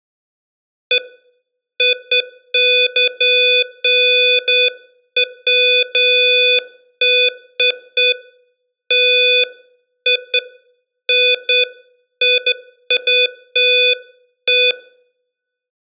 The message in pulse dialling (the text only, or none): none